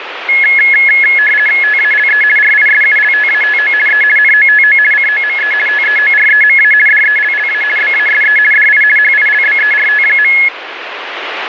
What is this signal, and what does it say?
RTTY (50 baud, 450 Hz shift), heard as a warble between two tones, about 1950 Hz centre, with radio static. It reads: TALE RISULTATO E NOTO COME TEOREMA DELLA BASE DI HILBERT.